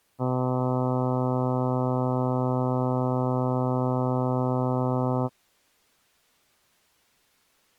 Ship horn signal, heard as a ship's horn, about 130 Hz. 1 long. At sea: a vessel nearing a blind bend, or under power and making way in fog.